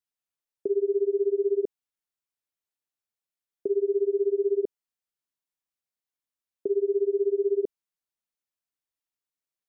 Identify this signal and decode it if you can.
Telephone call progress tone (Japanese plan), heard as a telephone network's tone, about 380, 400, 420 Hz, 1 s on and 2 s off. Ringback tone.